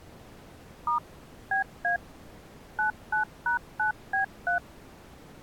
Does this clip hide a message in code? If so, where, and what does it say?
Yes: DTMF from 0.9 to 4.6 s, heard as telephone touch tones, dialled by machine, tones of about 120 ms. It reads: * BA 99#9B3